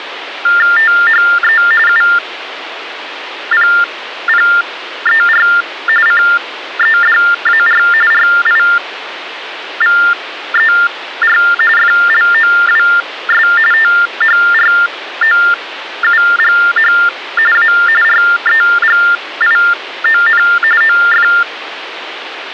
TTY/TDD text telephone tones (45.45 baud Baudot), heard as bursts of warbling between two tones, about 400 Hz shift, 1600 Hz centre, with phone line noise. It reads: THE UPPER CEDAR RIVER FLOWS THROUGH A REGION OF